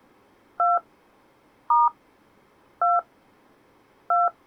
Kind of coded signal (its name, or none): DTMF